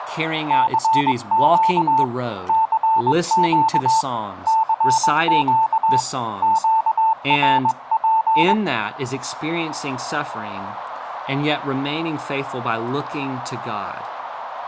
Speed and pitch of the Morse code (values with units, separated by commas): 21 wpm, 890 Hz